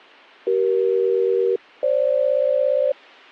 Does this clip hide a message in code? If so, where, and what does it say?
Yes: aircraft SELCAL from 0.5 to 2.9 s, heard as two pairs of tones. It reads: CE-FG